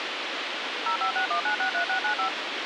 DTMF, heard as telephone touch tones, dialled by machine, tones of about 100 ms, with radio hiss. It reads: 0561963695